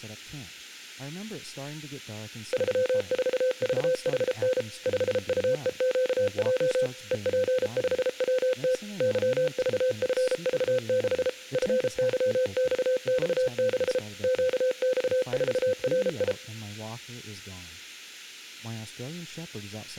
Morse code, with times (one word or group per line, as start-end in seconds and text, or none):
2.5-4.6 34VHN
4.9-6.9 5UEQJ
7.1-8.7 EP5WT
9.0-11.3 YVFV6
11.5-14.0 FYXX6
14.2-16.3 QX4RI